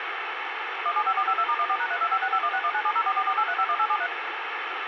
DTMF, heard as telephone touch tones, dialled by machine, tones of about 60 ms, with radio hiss and a squelch burst at the end. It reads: 175452*14#325651619704448351873